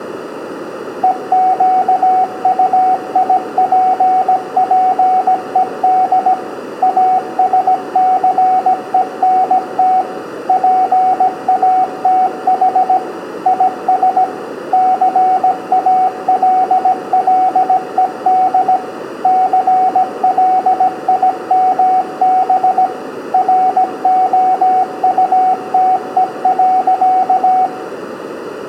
Morse code, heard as a keyed tone, machine-sent, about 17 wpm, 750 Hz, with room echo. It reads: EQUIPPED ASCENT PATH IS CALLED CLIMB ROUTE.